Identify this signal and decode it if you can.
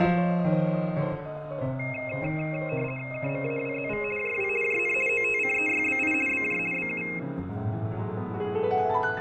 RTTY (50 baud, 450 Hz shift), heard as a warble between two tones, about 2350 Hz centre, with fading and room echo. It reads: KMAWZV JW JN OTCEYBI BJ BU